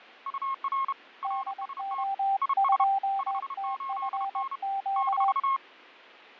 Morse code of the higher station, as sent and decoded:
..- .-. / .-. ... - / .. ... / ..... ---.. -. / -....-
UR RST IS 58N -

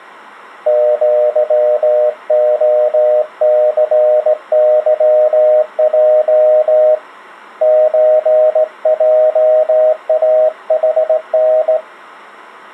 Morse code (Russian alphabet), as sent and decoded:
--.-- --- -.-. -.-- .--- / ---. .--- .- .... -.
ЪОЦЫЙ ЧЙАХН

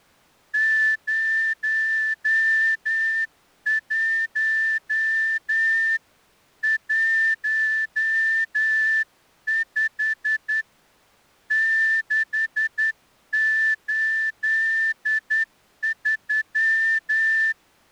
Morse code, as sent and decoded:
----- .---- / .---- ..... / -.... ---.. ...--
01 15 683

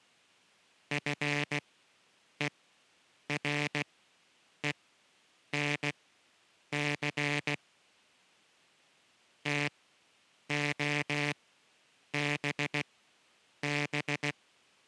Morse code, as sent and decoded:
..-. . .-. . -. -.-. / - --- -... -...
FERENC TOBB

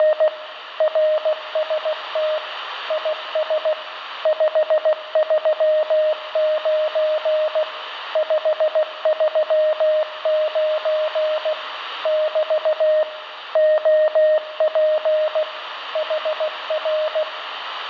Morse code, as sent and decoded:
… / .-. ... - / .. ... / ..... ...-- ----. / ..... ...-- ----. / -...- / --- .--. / .... .-.
… RST IS 539 539 <BT> OP HR

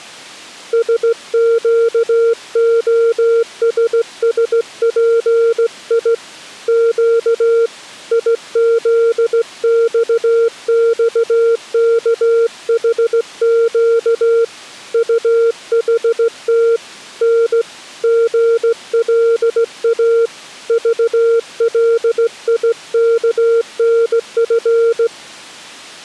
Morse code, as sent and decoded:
... --.- --- ... ... .--. .. / --.- / .. --.. -..- -..- -.- .... --.- / ..- .... - / -. / --. .-.. .- / ...- .-.. .. -.- -. ..-.
SQOSSPI Q IZXXKHQ UHT N GLA VLIKNF

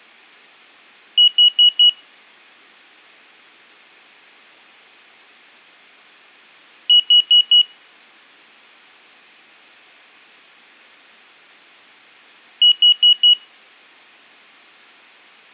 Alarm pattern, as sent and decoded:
4 beeps and a pause
temporal four

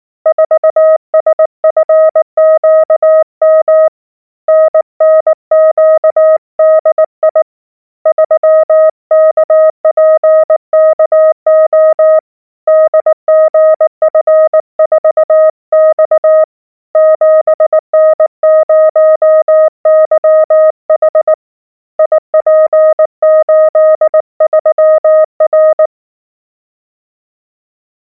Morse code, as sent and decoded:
....- ... ..-. --.- -- / -. -. --.- -.. .. / ...-- -.- .--. -.- --- / -.. --. ..-. ....- -..- / --... -. ----- -.-- .... / .. .--. ---.. ...-- .-.
4SFQM NNQDI 3KPKO DGF4X 7N0YH IP83R

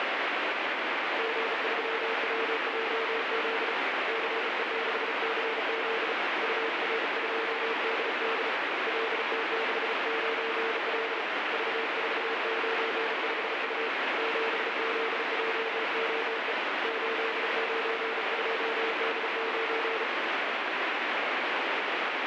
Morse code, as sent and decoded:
--. ...-- .-- .--- --.. / -.-. . -.... -.-. --.. / ..- .-. ..--- -.. -.. / .-.. - -.... ----. .-.. / ...- ....- ----. ..... ..- / --... --.. .--- --- . / ---.. ----. ..--- -.. ----.
G3WJZ CE6CZ UR2DD LT69L V495U 7ZJOE 892D9

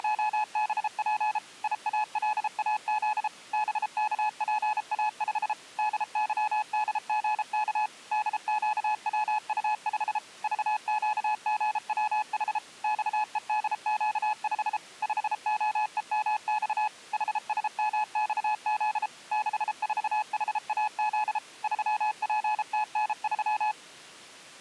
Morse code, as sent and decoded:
… / .. .- .-.. .- --.. / -... -.- .--. .- ..... / -.. -.-- -.. --. -.- / -.. --.- .-- ..- ..... / ...- --.- --. .-- .... / -..- . -.. --.- ..... / ..... --- . -- -..- / .... ... -- -..- --.. / -.... ....- .... .- --.. / ...-- .--. - -. ...--
… IALAZ BKPA5 DYDGK DQWU5 VQGWH XEDQ5 5OEMX HSMXZ 64HAZ 3PTN3

